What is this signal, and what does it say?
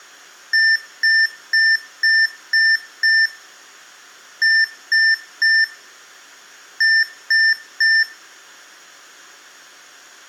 Beep code, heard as beeps from a small speaker, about 1800 Hz, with room echo. 6-3-3.